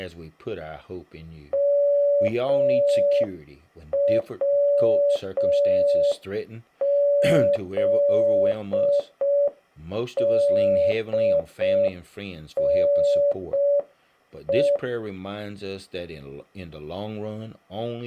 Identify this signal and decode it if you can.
Morse code, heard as a keyed tone, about 5 wpm, 570 Hz, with speech in English. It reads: MWZDNE